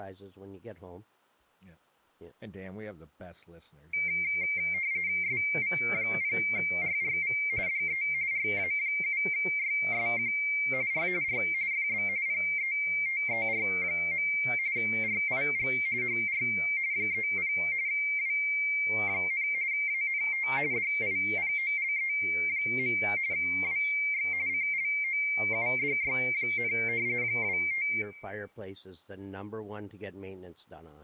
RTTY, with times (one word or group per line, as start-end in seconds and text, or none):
5.2-7.4 SV0RRV
7.7-8.0 DE
8.3-10.3 RA7YSQ
10.9-11.1 R
11.2-11.4 R
11.7-12.1 FB
12.3-14.3 PETER.
14.8-15.7 RIG
16.0-16.4 HR
16.9-17.5 30
17.9-19.5 W,
19.7-20.5 ANT
20.7-23.0 DIPOLE.
23.3-24.3 WX
24.5-26.7 CLOUDY,
27.2-27.9 25